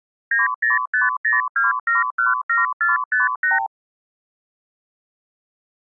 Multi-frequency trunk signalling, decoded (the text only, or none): 90502717458